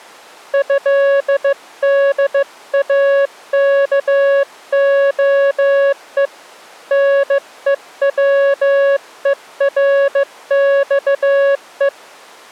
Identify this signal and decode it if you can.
Morse code (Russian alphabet), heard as a keyed tone, hand-sent with a bug key, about 15 wpm, 560 Hz. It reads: ЭДАКОЕ НЕВЕРЬЕ